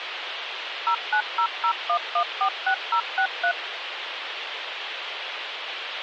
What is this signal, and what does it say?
DTMF, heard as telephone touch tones, dialled by machine, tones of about 80 ms, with phone line noise. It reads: 09001146063